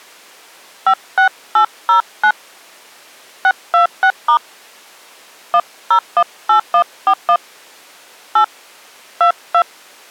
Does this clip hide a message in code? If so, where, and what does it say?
Yes: DTMF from 0.9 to 9.6 s, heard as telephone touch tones, dialled by hand, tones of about 100 ms. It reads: 56809 626* 1018141 8 22